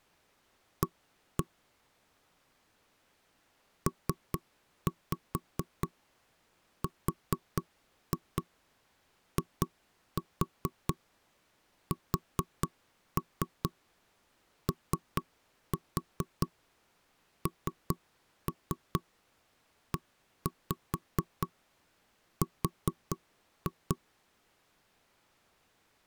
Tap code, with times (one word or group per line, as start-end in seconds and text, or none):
0.8-1.4 A
3.9-24.0 PRISONER